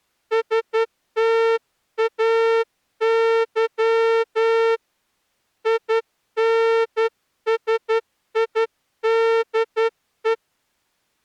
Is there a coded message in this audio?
Yes: Morse code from 0.3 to 10.4 s, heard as a horn, hand-sent with a straight key, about 11 wpm. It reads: STAY INSIDE